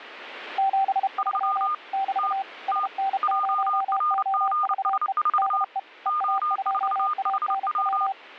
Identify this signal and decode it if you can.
Morse code, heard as two keyed tones. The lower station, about 32 wpm, 780 Hz: 73 <BT> SN0OVE DE EA2ANW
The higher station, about 29 wpm, 1220 Hz: 3 T T JRGS4 O4HW